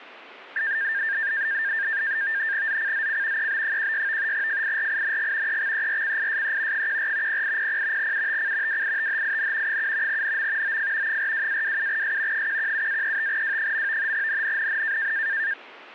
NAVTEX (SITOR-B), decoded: ZCZC EB16 FIRING EXERCISE 14 0800 UTC WITHIN 7 NM OF 42-27S 117-35W. NNNN

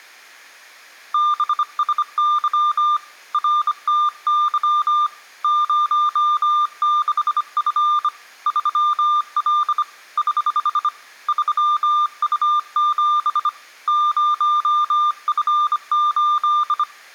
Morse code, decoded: BSY RTY 06F 3L <HH> 3U7 0F8

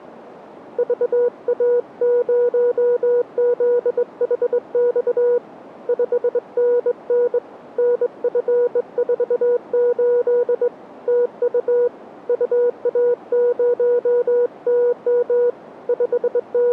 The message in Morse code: VA0ZHX 5NN NF48 TU UA0TM …

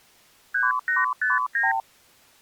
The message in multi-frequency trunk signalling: 3859

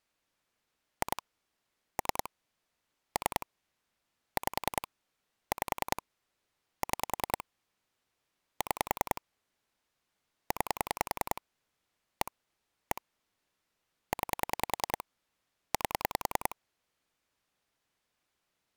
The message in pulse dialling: 2 3 3 5 5 6 6 9 1 1 9 8

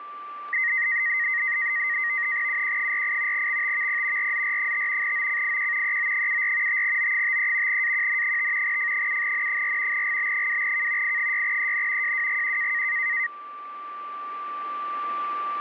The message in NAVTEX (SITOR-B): UQ48 XTVP RZR5 OCIQ EO74 5O53 AQN5 F7N4 GB2K I6EN JWGQ

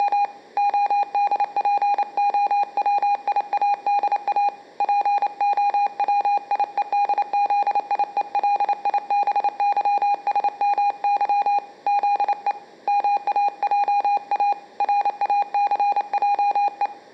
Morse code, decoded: … ODPOWIADA POWIEDZIELIBYSMY ZE MAJA RACJE

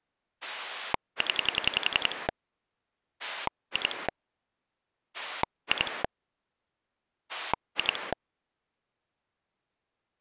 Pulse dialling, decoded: 0 2 2 2

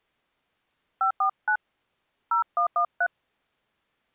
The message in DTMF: 549 0113

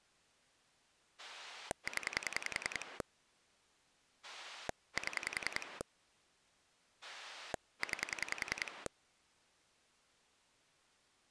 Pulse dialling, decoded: 0 7 9

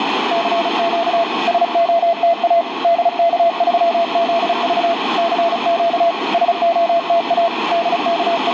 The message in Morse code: CQ SOTA DK3ZV CQ SOTA …

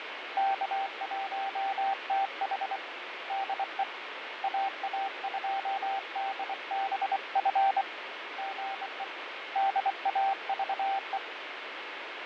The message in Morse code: K1TH DE AA2DBF GE DAVE

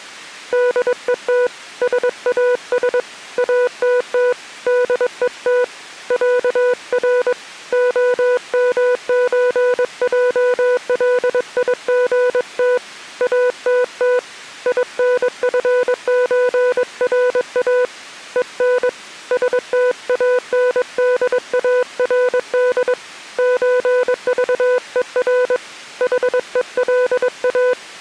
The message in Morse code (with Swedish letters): DET SAS ATT DET ÄR OMÖJLIGT ATT INFÖRA EN STANDARD ÖVER HELA

